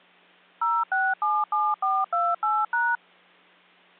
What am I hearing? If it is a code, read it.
DTMF, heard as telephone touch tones, dialled by machine, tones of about 220 ms. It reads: 0677428#